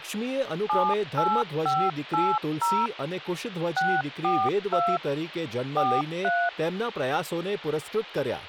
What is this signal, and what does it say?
DTMF, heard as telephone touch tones, dialled by machine, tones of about 240 ms, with phone line noise and speech in Gujarati. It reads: 78580 642 43